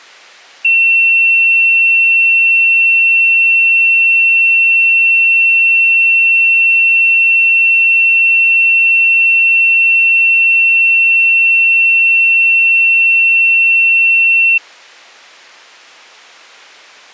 A steady tone. There is no code.